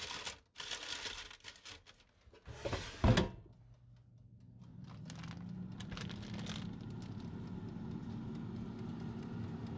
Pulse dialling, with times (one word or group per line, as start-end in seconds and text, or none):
none